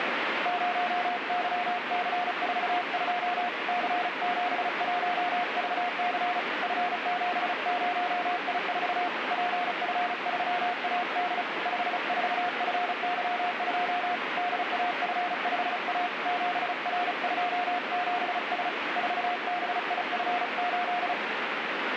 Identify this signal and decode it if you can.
Morse code, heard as a keyed tone, hand-sent with a paddle, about 35 wpm, 710 Hz, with radio static. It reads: 0YC42 C71VC F70I4 PF3AD 54FY2 DAF5A 7R27S 4BIF8